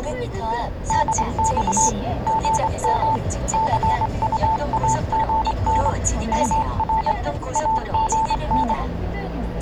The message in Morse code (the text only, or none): DX GM CUAGN UR AGN